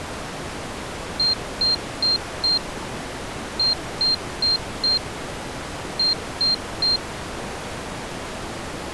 Beep code, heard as a piezo beeper, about 4200 Hz. 4-4-3. In Phoenix BIOS tables: maths coprocessor failure.